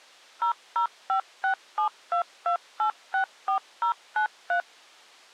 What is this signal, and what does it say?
DTMF, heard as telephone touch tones, dialled by machine, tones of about 100 ms. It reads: 0056722864093